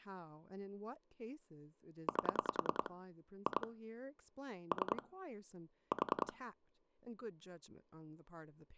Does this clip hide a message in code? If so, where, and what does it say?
Yes: pulse dialling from 2.1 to 6.3 s, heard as clicks on a phone line, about 10 pulses a second, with speech in English. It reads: 8 2 3 4